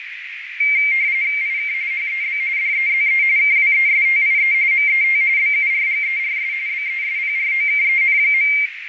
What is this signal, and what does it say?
RTTY (45.45 baud, 170 Hz shift), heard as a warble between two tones, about 2200 Hz centre, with radio static, fading and a narrow filter. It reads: IK HEB DEZE KWESTIE MET BURGERS BESPROKEN.